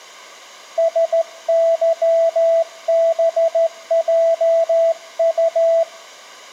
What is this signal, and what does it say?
Morse code, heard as a keyed tone, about 14 wpm, 660 Hz, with room echo. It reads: SYBJU